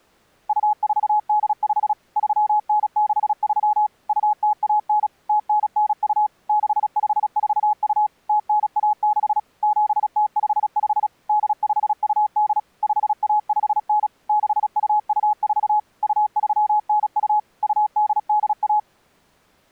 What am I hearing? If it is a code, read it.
Morse code (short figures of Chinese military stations), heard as a keyed tone, machine-sent, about 36 wpm, 840 Hz. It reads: 2485 3963 2019 0992 6542 0916 7055 8528 5159 6224 2392 2881